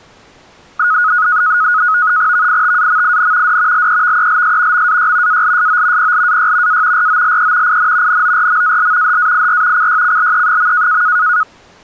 NAVTEX (SITOR-B), 100 baud, 170 Hz shift, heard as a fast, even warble, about 1360 Hz centre. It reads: VITAMIN D LEVELS MAY ALSO PLAY A ROLE IN NORMAL HAIR CYCLE.